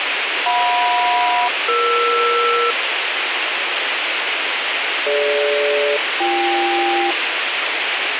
Aircraft SELCAL, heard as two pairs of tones, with radio hiss. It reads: JM-ER DG-BK